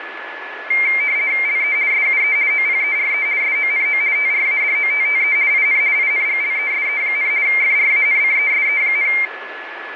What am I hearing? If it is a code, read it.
RTTY (50 baud, 170 Hz shift), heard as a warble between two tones, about 2200 Hz centre, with radio static and a steady whistle near 1720 Hz. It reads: LE SUE OPERE SONO TRADOTTE IN INGLESE, FRANCESE,